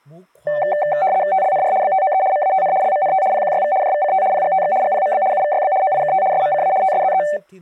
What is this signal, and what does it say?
RTTY (75 baud, 170 Hz shift), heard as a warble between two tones, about 680 Hz centre, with speech in Sindhi. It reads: TLNR BTOE MATN LMNT PQYV JVCT PGTX GPMB UVYB OIKT SMCA TSZE